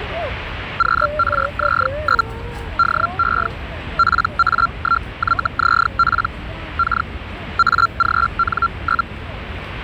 Hellschreiber (Feld-Hell, 122.5 baud), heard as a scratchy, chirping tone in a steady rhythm, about 1370 Hz, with the noise of a residential street. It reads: QRZ? DE PA1YZP K AGN?